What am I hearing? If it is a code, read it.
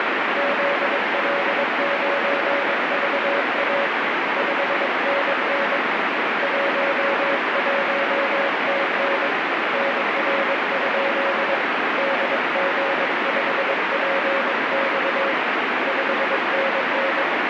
Morse code, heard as a keyed tone, hand-sent with a paddle, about 22 wpm, 560 Hz, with heavy radio static. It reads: ZL9VA 5NN 11TN NR? DG5PX 5NN